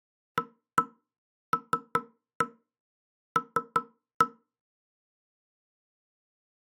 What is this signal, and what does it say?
Tap code, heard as knocks on wood, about 5 knocks a second. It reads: ALL